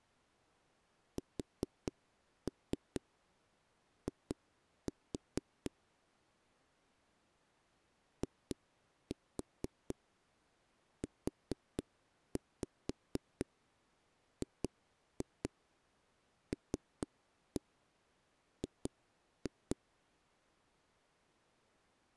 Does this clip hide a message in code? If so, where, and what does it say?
Yes: tap code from 1.2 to 19.8 s, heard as knocks on a wall, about 4 knocks a second. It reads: SI IUGLG